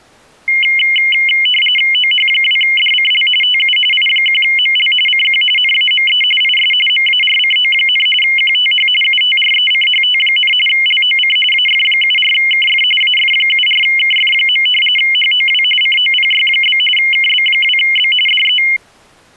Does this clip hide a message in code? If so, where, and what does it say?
Yes: RTTY (45.45 baud, 850 Hz shift) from 0.5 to 18.8 s, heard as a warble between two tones, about 2550 Hz centre. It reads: OH2DCL TU I1ML CQ NAME IS MARCO, QTH UTRECHT, LOC AF74KF AF74KF. HOW COPY? KB2B DE